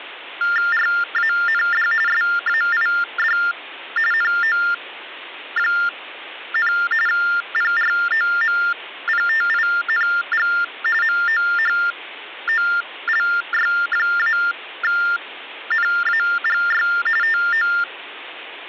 TTY/TDD text telephone tones (45.45 baud Baudot), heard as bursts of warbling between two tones, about 400 Hz shift, 1600 Hz centre. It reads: RAND SAID NO, PROMPTING MOHOLY-NAGY TO